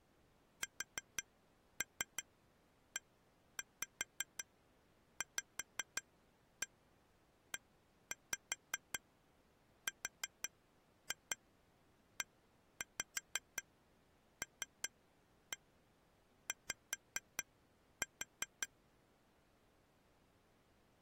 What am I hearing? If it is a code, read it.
Tap code, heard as taps on glass, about 5 knocks a second. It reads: SEVERELY